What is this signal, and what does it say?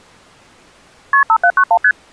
Multi-frequency trunk signalling (R1, as on North American trunks), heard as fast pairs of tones, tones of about 70 ms. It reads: KP 5791 ST